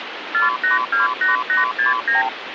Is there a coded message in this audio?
Yes: multi-frequency trunk signalling (R2, with the far end's replies) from 0.3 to 2.3 s, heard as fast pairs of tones, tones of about 140 ms, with phone line noise. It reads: 4828869